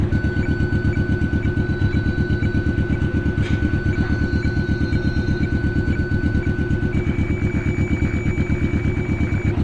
Weather fax (radiofax), 120 lines a minute, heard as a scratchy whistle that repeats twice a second, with radio static and street noise.